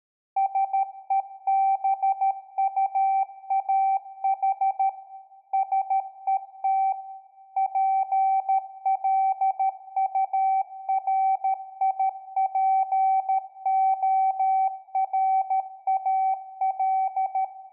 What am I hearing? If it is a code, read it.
Morse code, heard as a keyed tone, machine-sent, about 13 wpm, 770 Hz, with room echo. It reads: SEBUAH SET PLURIPORAL